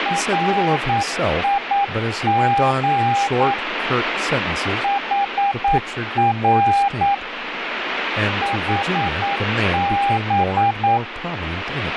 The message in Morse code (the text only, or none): RIG HR HB